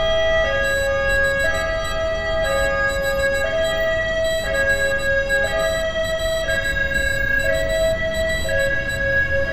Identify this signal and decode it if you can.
Morse code, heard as a high beeper, machine-sent, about 16 wpm, 3950 Hz, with street noise. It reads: THE THE CULTURE